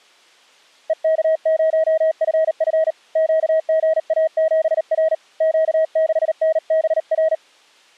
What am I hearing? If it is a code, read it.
Morse code, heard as a keyed tone, hand-sent with a paddle, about 38 wpm, 640 Hz. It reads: EK0FF QGA7R Q6NBR